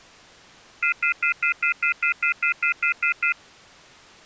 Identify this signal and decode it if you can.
Telephone call progress tone (North American plan), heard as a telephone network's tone, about 1400, 2050, 2450, 2600 Hz, 0.1 s on and 0.1 s off. Off-hook warning tone.